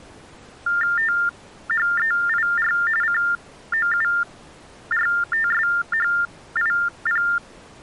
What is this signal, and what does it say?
TTY/TDD text telephone tones (45.45 baud Baudot), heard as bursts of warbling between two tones, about 400 Hz shift, 1600 Hz centre. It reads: THEIR COURTSHIP